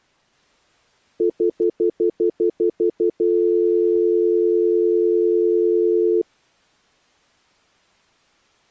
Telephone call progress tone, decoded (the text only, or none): stutter dial tone